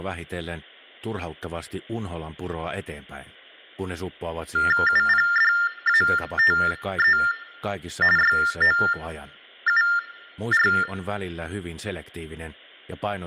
TTY/TDD text telephone tones (45.45 baud Baudot), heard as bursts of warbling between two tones, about 400 Hz shift, 1600 Hz centre. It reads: UPDATE YOUR